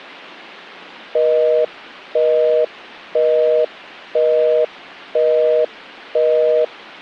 Telephone call progress tone (North American plan), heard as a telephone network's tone, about 480, 620 Hz, 0.5 s on and 0.5 s off. Busy tone.